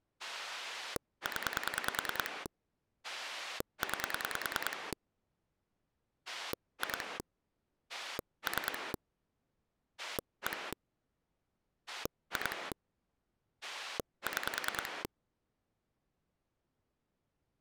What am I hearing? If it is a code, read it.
Pulse dialling, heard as a rotary dial, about 10 pulses a second. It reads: 0 9 2 3 1 2 6